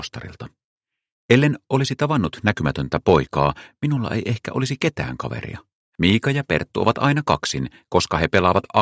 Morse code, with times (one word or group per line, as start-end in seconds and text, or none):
none